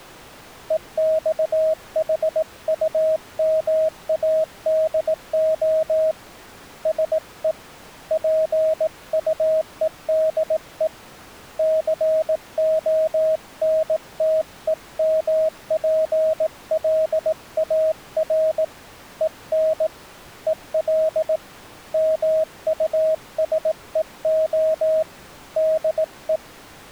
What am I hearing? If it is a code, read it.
Morse code, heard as a keyed tone, hand-sent with a paddle, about 18 wpm, 630 Hz. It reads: EXHUMADO SE PUEDE CONTEMPLAR EN EL MUSEO DE